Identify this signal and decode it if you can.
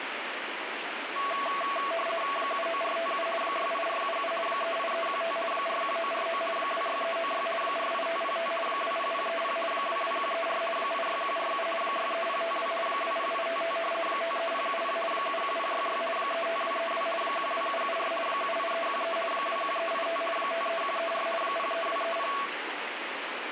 RTTY (50 baud, 450 Hz shift), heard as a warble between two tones, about 890 Hz centre, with radio static. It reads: 79457 68477 38315 41949 26396 48505 20030 22134 86147 63052 20855 53070 71066 35232 12774 78313 21385 53134 03230